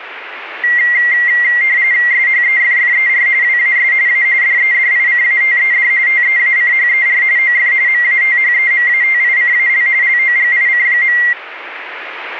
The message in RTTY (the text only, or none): SHEFFER WAS A DEDICATED TEACHER OF MATHEMATICAL LOGIC.